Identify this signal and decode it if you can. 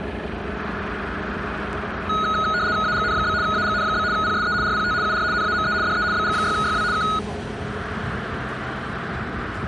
RTTY (75 baud, 170 Hz shift), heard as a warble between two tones, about 1360 Hz centre, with street noise. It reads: AGN? AGN? PSE RPT UR NAME DE BG6YW K